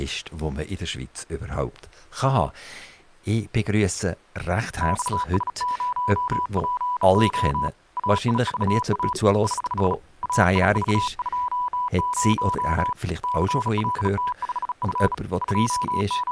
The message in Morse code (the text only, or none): XS0PO AIVA <HH> AIV20 CLT5F …